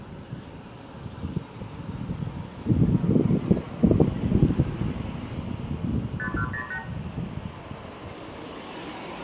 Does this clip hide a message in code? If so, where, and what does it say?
Yes: multi-frequency trunk signalling (R2, with the far end's replies) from 6.2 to 6.8 s, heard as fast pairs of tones, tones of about 80 ms, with room echo and street noise. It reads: 5108